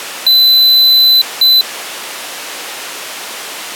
Beep code, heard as a piezo beeper, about 4000 Hz. 1 long, 1 short. In IBM BIOS tables: system board problem.